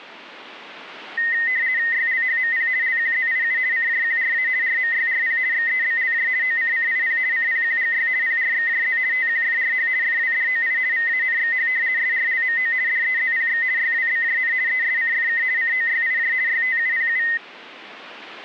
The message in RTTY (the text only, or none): YLHMP LQZIU CJQRA RMYRP XEBLJ OCCIP CPQGY PRXJZ TQFRH FWDOI VANXH SRLMO DEZPX YWBJN ESCFK COYIJ YTUPU